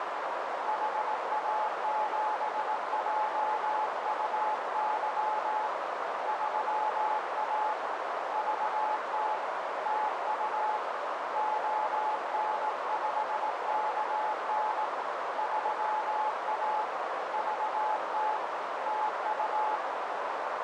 Morse code, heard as a keyed tone, hand-sent with a paddle, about 18 wpm, 860 Hz, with heavy radio static and a narrow filter. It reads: HA7JUY 3A VT TU ON5KN 3A VT TU